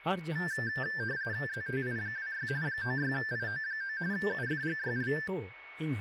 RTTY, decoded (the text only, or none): ZTI26 96IO9 UFGYL